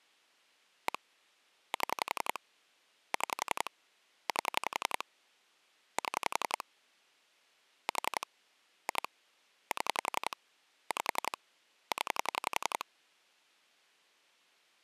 Pulse dialling, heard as clicks on a phone line, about 11 pulses a second. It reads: 1 7 6 8 7 4 2 7 5 0